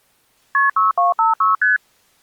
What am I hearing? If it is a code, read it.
Multi-frequency trunk signalling (R1, as on North American trunks), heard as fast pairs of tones, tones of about 150 ms. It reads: KP 6256 ST